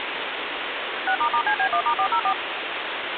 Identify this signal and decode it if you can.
DTMF, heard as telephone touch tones, dialled by machine, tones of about 80 ms, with phone line noise. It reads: 6**CB1*404